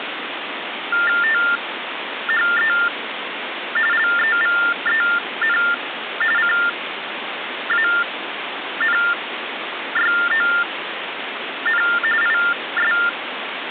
TTY/TDD text telephone tones (45.45 baud Baudot), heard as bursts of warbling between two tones, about 400 Hz shift, 1600 Hz centre, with phone line noise. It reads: THE LEVEN CANYON IS